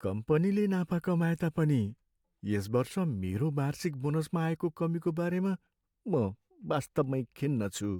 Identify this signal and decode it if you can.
Speech in Nepali. There is no code.